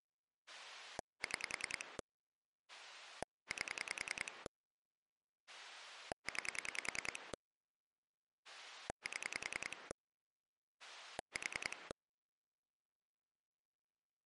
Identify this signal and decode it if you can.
Pulse dialling, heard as a rotary dial, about 10 pulses a second. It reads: 6 8 9 7 4